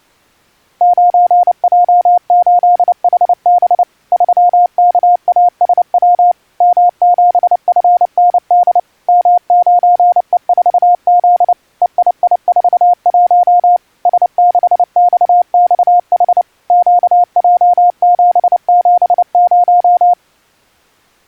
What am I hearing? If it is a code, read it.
Morse code, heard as a keyed tone, machine-sent, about 29 wpm, 710 Hz. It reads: 9J8HB 3KASW M7FND M9E4Z EII41 S6XXH QJ770